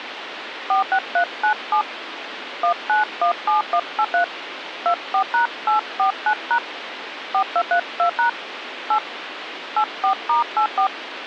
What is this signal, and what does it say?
DTMF, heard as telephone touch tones, dialled by hand, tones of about 100 ms, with phone line noise. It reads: 46397 1917183 24#849# 4232# 8 84*84